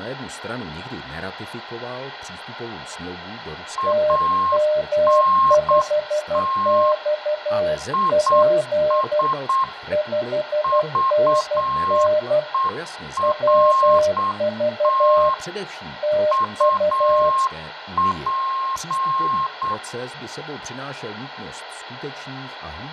Morse code, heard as two keyed tones, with radio static, fading, room echo and speech in Czech. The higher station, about 8 wpm, 1070 Hz: ANT IS VERT UP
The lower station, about 12 wpm, 610 Hz: TM5XP 5NN WV TU